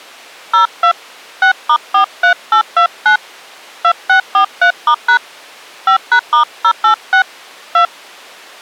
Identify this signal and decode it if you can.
DTMF, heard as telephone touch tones, dialled by hand, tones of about 100 ms. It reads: 02 6*43829 2643*# 5#*086 2